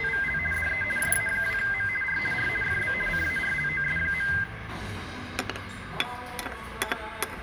RTTY (50 baud, 450 Hz shift), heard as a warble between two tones, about 1800 Hz centre, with radio static and the noise of a restaurant. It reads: … DE JA2M R R FB CARLOS.